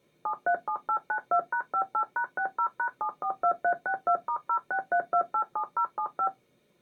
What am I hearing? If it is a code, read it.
DTMF, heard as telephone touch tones, dialled by machine, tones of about 80 ms. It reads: 737892#58#60#742362*063287075